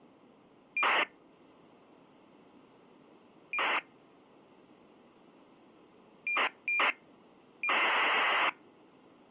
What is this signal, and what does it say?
ACARS aircraft data, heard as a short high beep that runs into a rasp, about 2400 baud.